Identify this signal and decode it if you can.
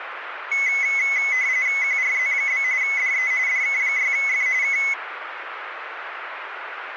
RTTY (45.45 baud, 170 Hz shift), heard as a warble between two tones, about 2100 Hz centre, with radio static. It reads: QRZ? DE DK6F K